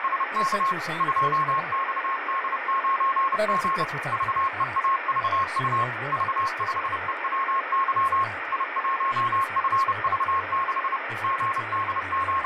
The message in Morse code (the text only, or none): … 2XD9G VEAVU V5EWY I1FV6 …